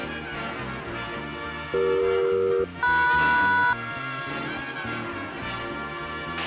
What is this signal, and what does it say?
Aircraft SELCAL, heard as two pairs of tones, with a squelch burst at the end. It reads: CE-MS